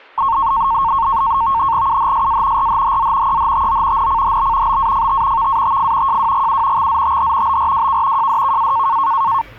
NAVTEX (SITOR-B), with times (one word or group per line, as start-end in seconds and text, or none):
1.9-2.7 UHSA
2.6-3.4 RHHZ
3.3-4.1 EHTO
4.0-4.8 NCHB
4.7-5.5 BAFT
5.4-6.2 VATF
6.1-6.9 JWGU
6.8-7.6 XZTH
7.5-8.3 BRWK
8.2-9.0 JDKA